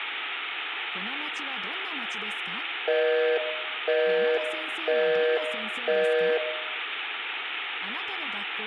Telephone call progress tone (North American plan), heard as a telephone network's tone, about 480, 620 Hz, 0.5 s on and 0.5 s off, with room echo. Busy tone.